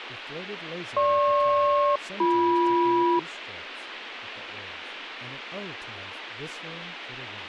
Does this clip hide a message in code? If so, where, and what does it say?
Yes: aircraft SELCAL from 1.0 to 3.2 s, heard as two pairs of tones, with radio hiss, a squelch burst at the end and speech in English. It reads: GP-BM